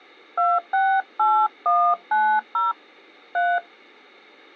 DTMF, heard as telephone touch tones, dialled by hand, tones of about 220 ms. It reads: 268190 3